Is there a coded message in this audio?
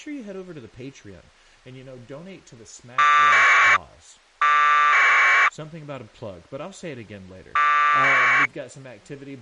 Yes: packet radio (AX.25, as in APRS), 1200 baud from 3.0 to 8.5 s, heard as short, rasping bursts, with speech in English.